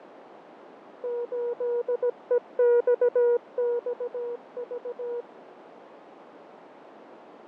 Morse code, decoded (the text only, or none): 8EXXV